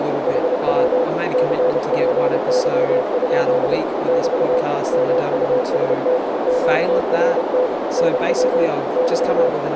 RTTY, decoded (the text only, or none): none